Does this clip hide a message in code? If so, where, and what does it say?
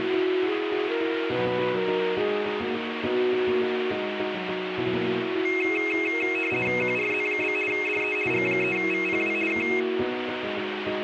Yes: RTTY (50 baud, 450 Hz shift) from 5.5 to 9.8 s, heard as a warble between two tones, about 2350 Hz centre, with radio static. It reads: QRZ? DE G3VPW K